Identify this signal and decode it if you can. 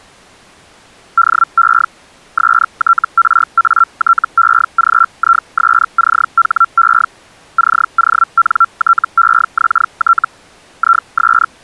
Hellschreiber (Feld-Hell, 122.5 baud), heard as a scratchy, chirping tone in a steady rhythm, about 1360 Hz. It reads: DE STRATEGISCHE CONTEXT IS